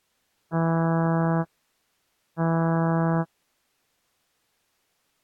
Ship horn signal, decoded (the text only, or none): 2 short